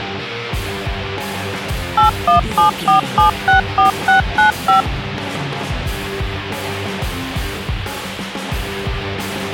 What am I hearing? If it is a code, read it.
DTMF, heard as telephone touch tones, dialled by machine, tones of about 120 ms. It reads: 8174764695